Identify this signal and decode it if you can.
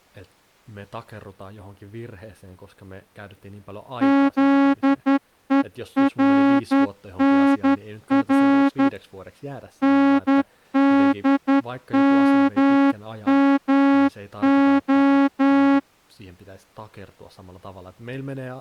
Morse code, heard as a horn, hand-sent with a straight key, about 11 wpm, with speech in Finnish. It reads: ZERNR NDMMO